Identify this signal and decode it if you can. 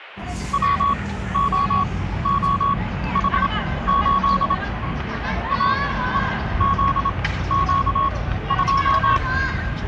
Morse code, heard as a keyed tone, machine-sent, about 27 wpm, spaced as for 15 wpm, 1110 Hz, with the noise of a park. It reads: WOOH8 AEZQ2